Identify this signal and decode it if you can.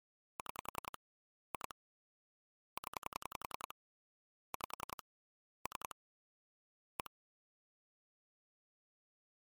Pulse dialling, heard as clicks on a phone line, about 10 pulses a second. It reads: 6 2 0 5 3 1